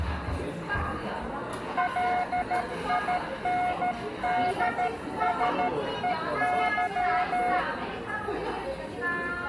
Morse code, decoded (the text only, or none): LINDSEY